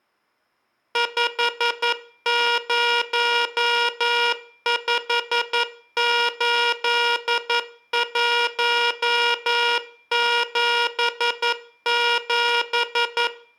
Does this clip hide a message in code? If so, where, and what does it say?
Yes: Morse code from 0.9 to 13.3 s, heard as a buzzer, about 11 wpm, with room echo. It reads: 5058177